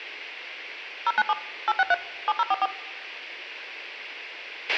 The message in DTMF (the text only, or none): 097 863 7044